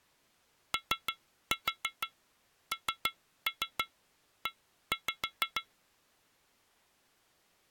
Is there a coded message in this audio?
Yes: tap code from 0.7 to 5.7 s, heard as taps on glass, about 6 knocks a second. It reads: ONE